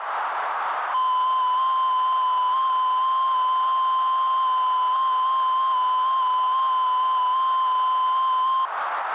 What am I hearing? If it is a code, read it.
FT8 (one signal), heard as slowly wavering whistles, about 6.25 baud, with radio static and a narrow filter.